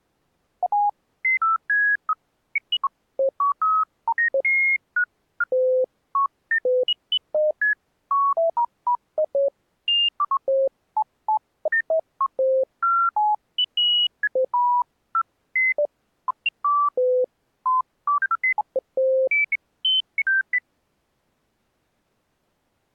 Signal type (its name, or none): none